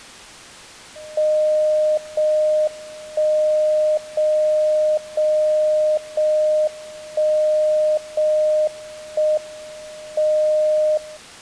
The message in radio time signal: 0 1 0 0 0 1 0 1 M 0

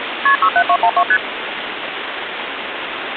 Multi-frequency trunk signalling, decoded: KP 67212 ST

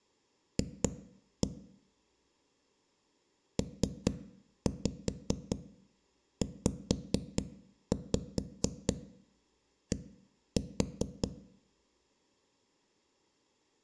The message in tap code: F PZD

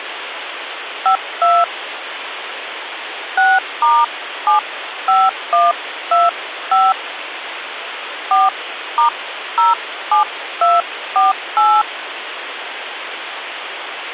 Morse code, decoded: none

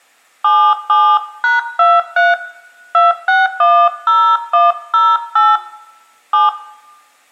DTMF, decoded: 77#23 2610108 7

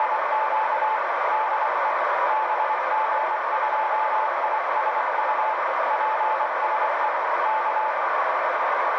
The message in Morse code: … DE BG2ISU PSE K

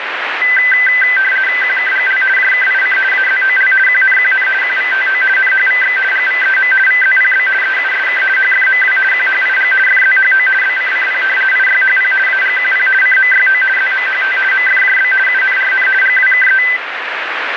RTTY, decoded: QKGL JKIC AZOL QNQN QVTO NHVX GVEM VZPB EUSK HFMW QHIG FZHO BCCP IYHP AGQP CMYO ZMHT MFJB UNRN GWKE

